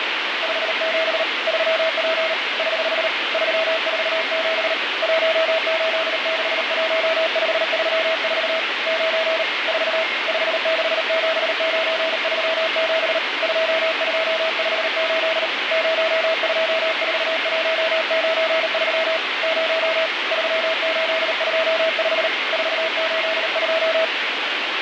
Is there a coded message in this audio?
Yes: Morse code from 0.4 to 24.1 s, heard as a keyed tone, hand-sent with a paddle, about 38 wpm, 650 Hz, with radio static and a weaker station near 2130 Hz. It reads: 57 3P <HH> 347 1861534 9 4 567937 2258 024193 0 3825 482